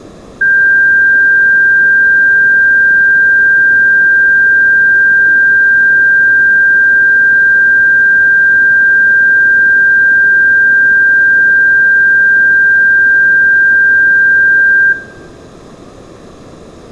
A steady tone, with room echo. There is no code.